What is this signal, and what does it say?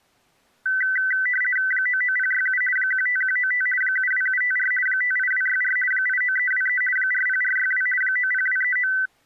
RTTY (50 baud, 450 Hz shift), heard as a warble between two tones, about 1750 Hz centre. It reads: 99067 15195 72754 58264 89323 40462 90239